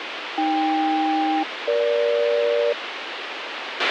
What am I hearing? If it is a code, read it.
Aircraft SELCAL, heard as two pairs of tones, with radio hiss and a squelch burst at the end. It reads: AK-EG